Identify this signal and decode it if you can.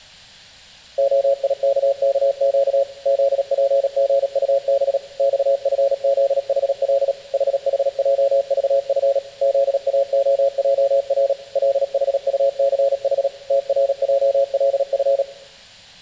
Morse code, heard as a keyed tone, machine-sent, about 37 wpm, 550 Hz, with room echo. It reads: OIKKQ ZPGUB XFZHL HHJVF ZAOJR LHUCH TRJLF